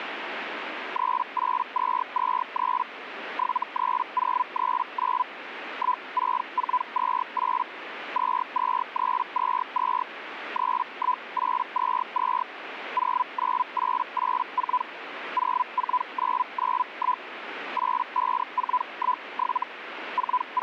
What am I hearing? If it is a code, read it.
Hellschreiber (Feld-Hell, 122.5 baud), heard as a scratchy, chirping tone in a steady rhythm, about 1000 Hz, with radio static. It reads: 38223 73039 16428 22322 31822 09884 04991 85417 …